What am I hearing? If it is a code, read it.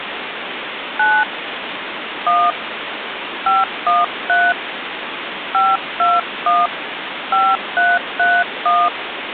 DTMF, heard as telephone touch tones, dialled by hand, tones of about 200 ms, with phone line noise. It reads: 9 1 513 521 5331